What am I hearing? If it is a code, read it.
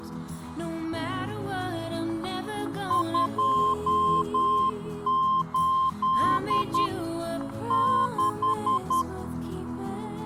Morse code, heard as a keyed tone, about 10 wpm, 1050 Hz, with static crashes. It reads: 28 6